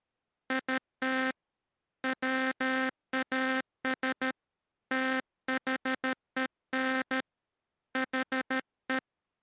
Morse code, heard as a buzzer, hand-sent with a paddle, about 13 wpm. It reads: IT WAS THEN HE